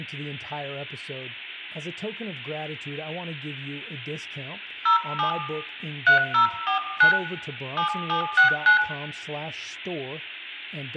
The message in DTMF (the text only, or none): 07 3049 7769